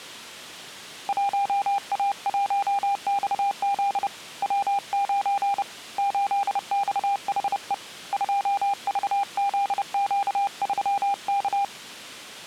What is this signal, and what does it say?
Morse code, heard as a keyed tone, hand-sent with a paddle, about 30 wpm, 800 Hz. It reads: 1A1XZ W9 8XHE 2VZQ3K